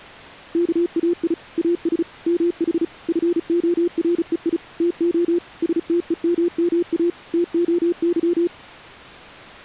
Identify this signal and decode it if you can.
Morse code (Greek alphabet), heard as a keyed tone, machine-sent, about 35 wpm, 350 Hz. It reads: ΚΑΙ ΑΣ ΜΗ ΦΟΡΕΙ ΤΟ ΣΤΕΜΜΑ ΤΟΥ